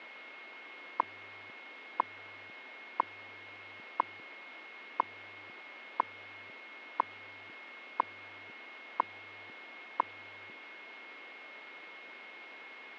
Radio time signal (WWV, Colorado), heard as ticks, one a second, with radio static and a steady whistle near 2160 Hz.